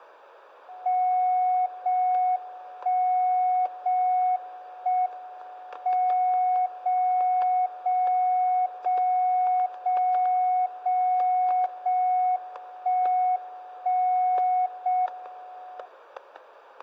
Radio time signal (JJY), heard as a tone whose level steps once a second, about 730 Hz, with static crashes and room echo. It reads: 0 1 0 1 M 0 0 0 0 0 0 1 1 0 M